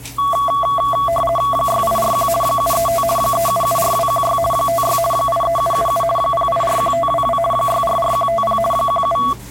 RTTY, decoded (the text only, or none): 6841 735 3774216 56 83777 0841522 644150 17